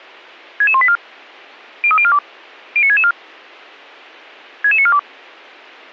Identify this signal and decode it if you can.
Five-tone selective call (ZVEI), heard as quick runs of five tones, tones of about 70 ms. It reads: 66184 03042 09664 66942